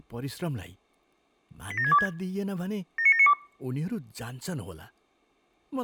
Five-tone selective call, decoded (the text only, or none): 87626 79792